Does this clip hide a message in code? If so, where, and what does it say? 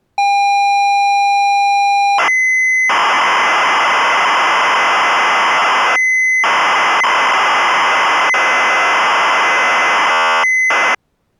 Yes: ZX Spectrum tape loading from 0.2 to 10.9 s, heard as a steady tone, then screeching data.